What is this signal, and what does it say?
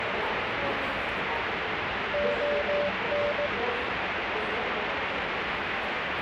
Morse code (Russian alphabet), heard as a keyed tone, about 17 wpm, 580 Hz, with radio static and the noise of a subway station. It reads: ОН